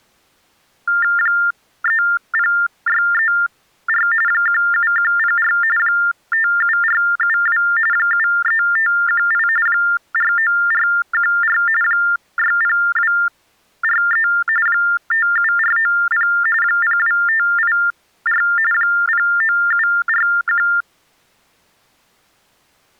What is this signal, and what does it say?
TTY/TDD text telephone tones (45.45 baud Baudot), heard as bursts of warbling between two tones, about 400 Hz shift, 1600 Hz centre. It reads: 30634 17104 57472 73518 49414 60243 57490 02584 09741